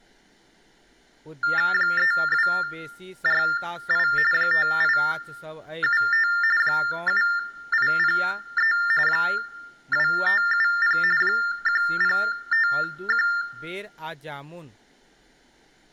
TTY/TDD text telephone tones (45.45 baud Baudot), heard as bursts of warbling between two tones, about 400 Hz shift, 1600 Hz centre, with room echo and speech in Maithili. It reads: 3248 5875 7803 2570 1051